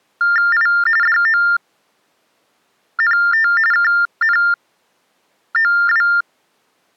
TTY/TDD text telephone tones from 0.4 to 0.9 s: I

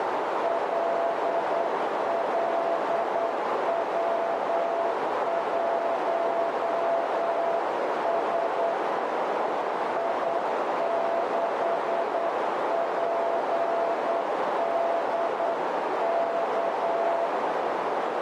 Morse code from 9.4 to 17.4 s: I6PDK

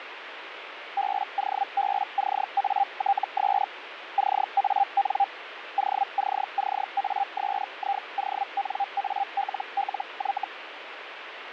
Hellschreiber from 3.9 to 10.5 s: CAN OCCASIONALLY

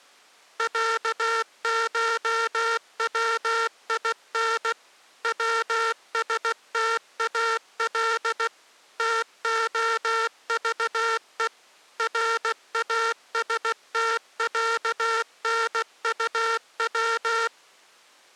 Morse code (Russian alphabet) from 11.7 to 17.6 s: РАСТЯНУВ

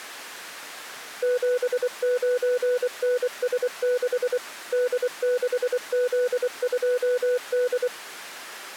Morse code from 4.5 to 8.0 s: D6Z2D

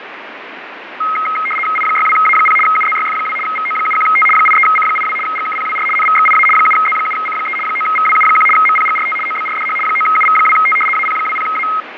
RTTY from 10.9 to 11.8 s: AP20A

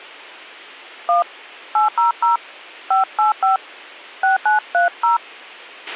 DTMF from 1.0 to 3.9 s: 1 800 585

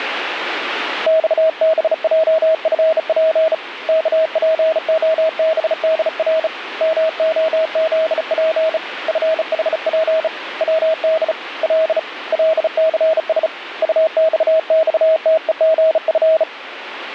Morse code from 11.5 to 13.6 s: L LCS

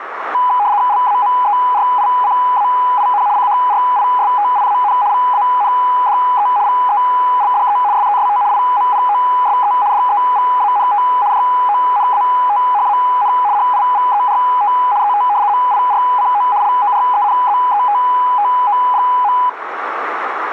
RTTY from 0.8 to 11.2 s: LAMERICAIN CHRISTIAN VANDE VELDE SEST IMPOSE DEVANT

